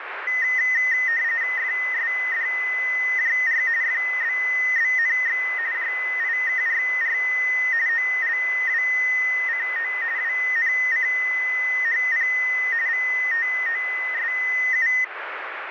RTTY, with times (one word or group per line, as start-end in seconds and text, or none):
1.6-3.6 FSDJR
3.8-5.4 FBBNX
5.7-7.2 JIKRR
7.9-9.9 OLWCO
10.2-12.3 WNCHP
12.9-14.9 VTOSU